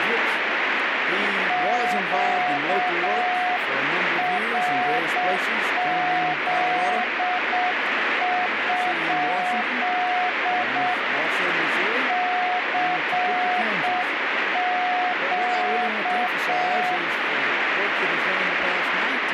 Morse code, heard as a keyed tone, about 7 wpm, 730 Hz, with radio static. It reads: QRZ? CQ